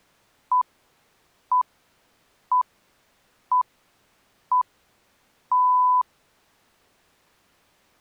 Radio time signal (six pips, as the Greenwich Time Signal), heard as pips.